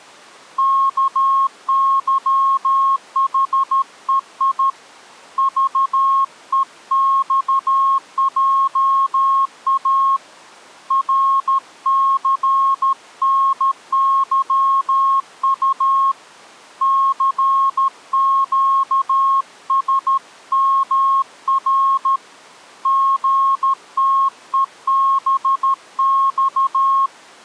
Morse code, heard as a keyed tone, hand-sent with a paddle, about 13 wpm, 1080 Hz. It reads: KYHEI VEXJA RCNYU CQSMR GTEBX